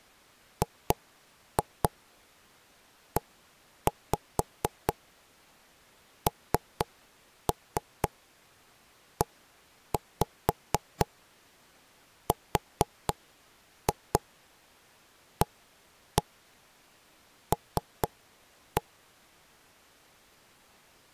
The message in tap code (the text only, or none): GENERAL